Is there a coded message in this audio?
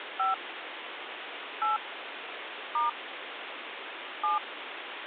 Yes: DTMF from 0.2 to 4.4 s, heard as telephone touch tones, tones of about 150 ms, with phone line noise. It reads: 5 8 * 7